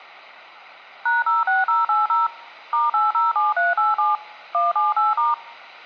DTMF, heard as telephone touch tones, dialled by machine, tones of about 170 ms. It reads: #06080 *807387 178*